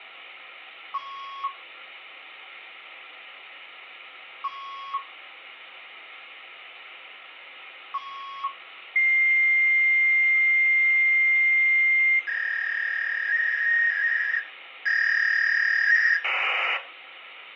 Fax machine handshake, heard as beeps, a long tone, a warble and hiss, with phone line noise.